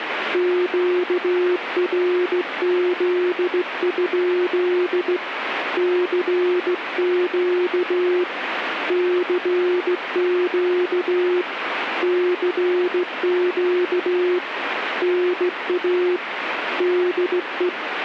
Morse code, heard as a keyed tone, hand-sent with a straight key, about 16 wpm, 360 Hz, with radio static. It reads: QRZ? CQ CQ CQ NA DE